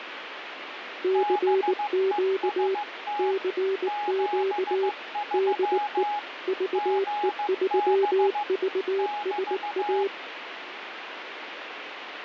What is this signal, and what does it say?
Morse code, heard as two keyed tones, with radio static. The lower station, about 19 wpm, 390 Hz: CQ CQ DE VE3VSA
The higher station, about 15 wpm, 830 Hz: BEST 73 GB <BT>